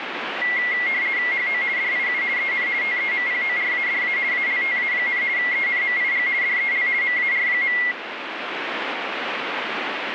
RTTY (50 baud, 170 Hz shift), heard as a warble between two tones, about 2050 Hz centre, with radio static. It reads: HO DIU EN TEMPORADA ALTA, ENMIG DEL MAR.